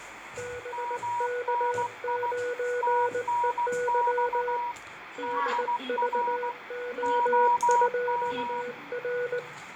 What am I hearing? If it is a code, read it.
Morse code, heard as two keyed tones, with radio static, fading, room echo and the noise inside a lift. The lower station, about 19 wpm, 490 Hz: BK9EY DVO2R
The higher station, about 16 wpm, 960 Hz: MNI TNX DR OM